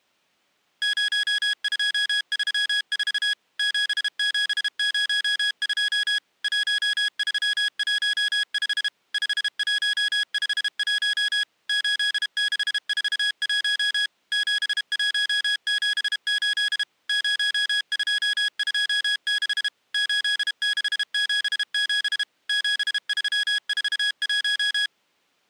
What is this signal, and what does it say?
Morse code, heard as electronic beeps, machine-sent, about 32 wpm, 1650 Hz. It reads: 0234 7702 1315 5151 8641 7178 0226 8677 7341